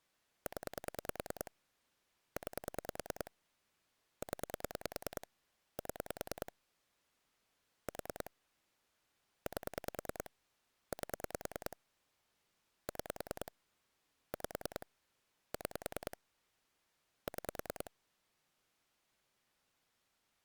Pulse dialling, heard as clicks on a phone line, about 10 pulses a second. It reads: 0 9 0 7 4 8 8 6 5 6 6